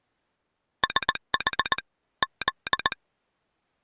Morse code, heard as a telegraph sounder, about 19 wpm. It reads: SH Z